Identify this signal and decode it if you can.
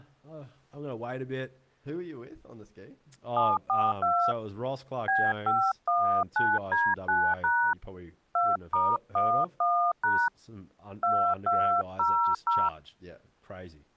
DTMF, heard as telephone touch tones, dialled by hand, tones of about 260 ms, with speech in English. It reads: 742 B519D9# 2*11# 2200